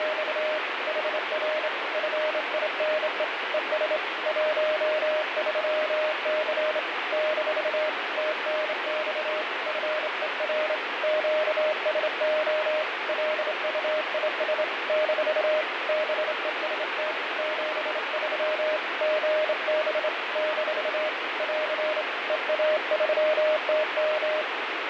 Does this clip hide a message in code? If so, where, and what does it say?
Yes: Morse code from 0.0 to 24.5 s, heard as a keyed tone, hand-sent with a straight key, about 27 wpm, 620 Hz, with heavy radio static and fading. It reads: … HR FINE ES 13C - TNX FER QSO LUIS - BEST 73 GB - <AR> EA3TM